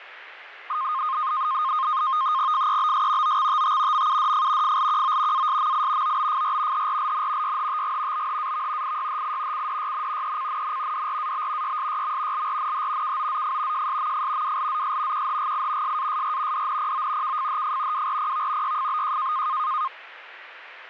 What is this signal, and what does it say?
NAVTEX (SITOR-B), 100 baud, 170 Hz shift, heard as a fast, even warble, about 1150 Hz centre, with radio static and fading. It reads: FEBS OXTT MUDF FLQO ASMI OBFR HRLN YHTG BHAV IYHI CDYN ECNN DRAB YSYM LRNH KOZF JSMF WLZS QHGI SASR DNPO KFHF WRPV YFBJ